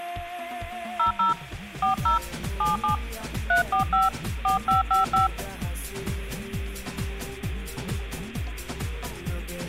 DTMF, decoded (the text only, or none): 00 40 77 345 4555